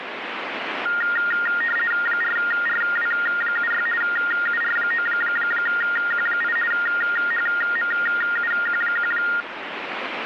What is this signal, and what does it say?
RTTY (50 baud, 450 Hz shift), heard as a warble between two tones, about 1650 Hz centre, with radio static. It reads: 4RW76 UR9Q8 HMUQ1